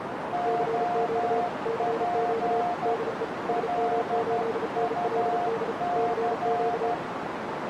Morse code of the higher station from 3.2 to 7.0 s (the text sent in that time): LUC